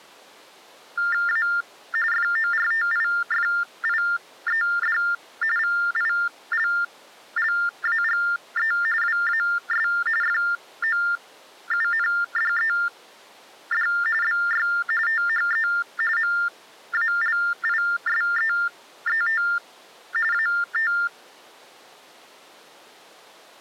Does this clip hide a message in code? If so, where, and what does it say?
Yes: TTY/TDD text telephone tones (45.45 baud Baudot) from 1.0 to 21.1 s, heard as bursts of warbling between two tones, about 400 Hz shift, 1600 Hz centre. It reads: A FORTIFIED VILLAGE WAS FOUNDED BY THE MALISEET AT